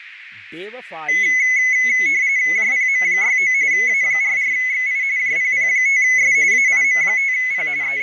RTTY (45.45 baud, 170 Hz shift), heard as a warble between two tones, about 2100 Hz centre, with radio static, fading, a narrow filter and speech in Sanskrit. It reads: JPM69 A44XI JPP5S AIM5P …